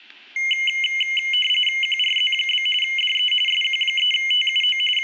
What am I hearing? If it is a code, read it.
RTTY (45.45 baud, 850 Hz shift), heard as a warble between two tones, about 2550 Hz centre, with static crashes and room echo. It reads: QRZ? DE SQ3TUO …